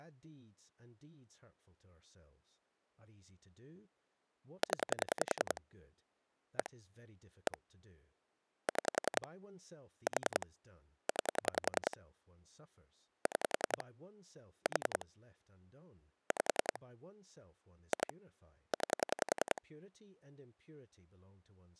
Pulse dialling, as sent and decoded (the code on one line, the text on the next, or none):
10 / 1 / 1 / 6 / 4 / 9 / 6 / 4 / 5 / 2 / 9
0 1 1 6 4 9 6 4 5 2 9